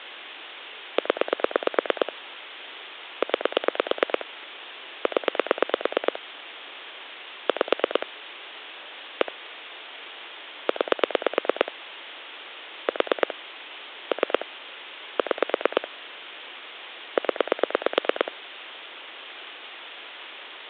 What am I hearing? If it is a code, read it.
Pulse dialling, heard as clicks on a phone line, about 9 pulses a second. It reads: 0 9 0 5 1 9 4 3 6 0